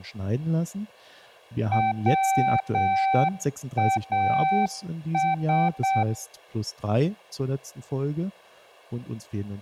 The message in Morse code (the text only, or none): WAS